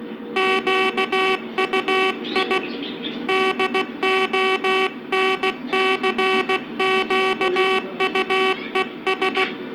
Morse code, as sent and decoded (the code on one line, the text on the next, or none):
--.- ..- .. / -.. --- -. -.-. --.- ..- . ...
QUI DONCQUES